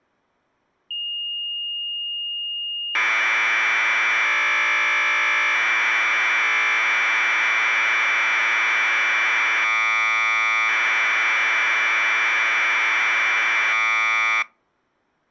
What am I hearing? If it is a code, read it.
Commodore tape loading (standard loader), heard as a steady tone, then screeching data.